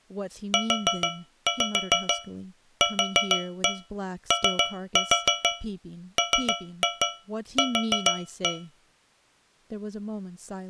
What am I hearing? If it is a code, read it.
Tap code, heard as taps on a metal pipe, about 6 knocks a second, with speech in English. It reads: UQOMQ